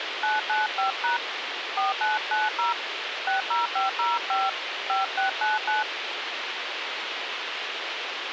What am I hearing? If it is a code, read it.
DTMF, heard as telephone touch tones, dialled by hand, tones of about 160 ms, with radio hiss. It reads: 995# 4990 60505 5699